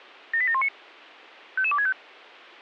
Five-tone selective call (ZVEI), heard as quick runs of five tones, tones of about 70 ms. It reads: 78719 55265